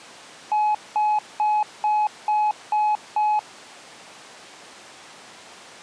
Beep code, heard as beeps, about 850 Hz. 7 short. In AMI BIOS tables: virtual mode exception error; in Dell tables: processor failure.